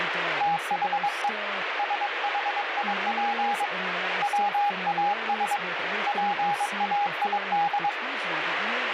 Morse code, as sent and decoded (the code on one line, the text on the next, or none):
- .... . / ... .... .. .--. / .-- .- ... / .--. .- .. -..
THE SHIP WAS PAID